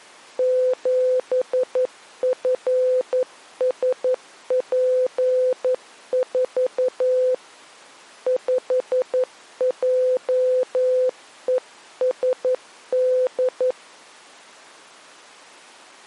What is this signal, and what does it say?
Morse code, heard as a keyed tone, hand-sent with a paddle, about 11 wpm, 510 Hz. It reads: 7FSP4 5JESD